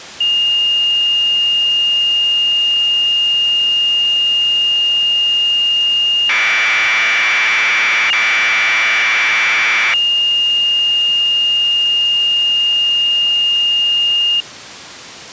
Commodore tape loading (standard loader), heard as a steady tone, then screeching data.